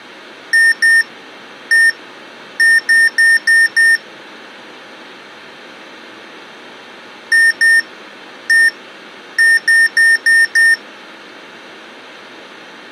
Beep code, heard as beeps from a small speaker, played twice, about 1800 Hz. 2-1-5.